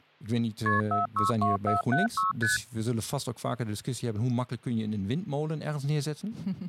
Multi-frequency trunk signalling (R1, as on North American trunks), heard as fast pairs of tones, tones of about 140 ms, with hum and speech in Dutch. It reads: KP 462476 ST